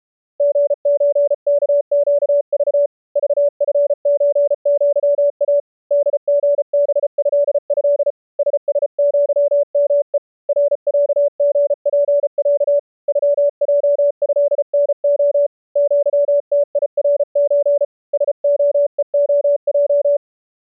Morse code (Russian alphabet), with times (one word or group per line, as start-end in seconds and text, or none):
0.4-2.9 ГЧКЩЖ
3.2-5.6 ЖФЧЪА
5.9-8.1 ДГБЭЭ
8.4-10.2 ССЪМЕ
10.5-12.8 РЯГПЯ
13.1-15.5 ЮЙЭНО
15.8-17.8 ЪТИРЧ
18.1-20.2 СОЕОЙ